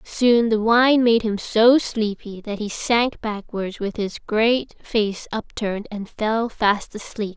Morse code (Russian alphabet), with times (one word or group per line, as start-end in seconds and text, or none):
none